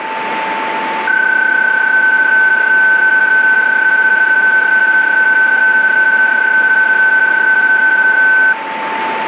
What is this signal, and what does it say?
PSK31 (31.25 baud), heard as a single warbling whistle, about 1500 Hz, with radio static and a steady whistle near 890 Hz.